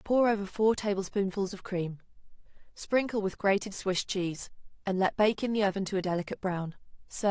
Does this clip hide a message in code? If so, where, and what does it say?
No, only speech in English.